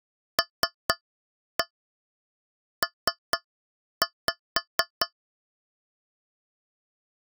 Tap code, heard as taps on a metal pipe, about 4 knocks a second. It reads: LP